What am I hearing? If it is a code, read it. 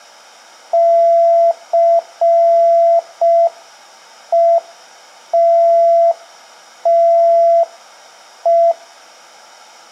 Morse code, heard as a keyed tone, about 5 wpm, 680 Hz, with room echo. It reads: CETTE